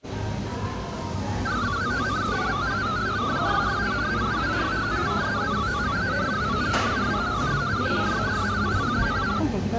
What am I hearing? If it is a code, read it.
Multi-tone FSK (Olivia or MFSK type), about 500 Hz wide, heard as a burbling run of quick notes, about 62.5 baud, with the noise of a cafe.